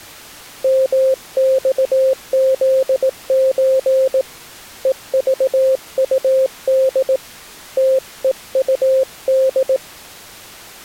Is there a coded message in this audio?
Yes: Morse code (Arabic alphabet) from 0.6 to 9.8 s, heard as a keyed tone, hand-sent with a paddle, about 18 wpm, 530 Hz. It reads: مصذز ءضطد تءطد